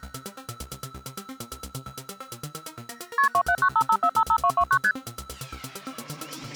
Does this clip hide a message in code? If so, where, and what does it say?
Yes: multi-frequency trunk signalling (R1, as on North American trunks) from 3.2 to 4.9 s, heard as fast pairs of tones, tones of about 70 ms. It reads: KP 27955455229 ST